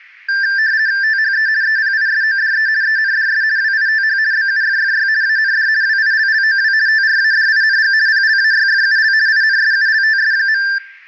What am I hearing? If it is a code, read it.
RTTY (50 baud, 170 Hz shift), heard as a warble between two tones, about 1700 Hz centre. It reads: THE EPISODE ENDS WITH BUFFY AND WILLOW TRADING PLAYFUL INSULTS.